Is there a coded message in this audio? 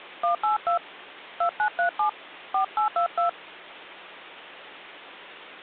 Yes: DTMF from 0.2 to 3.3 s, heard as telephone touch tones, dialled by hand, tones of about 110 ms. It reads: 182 2937 4822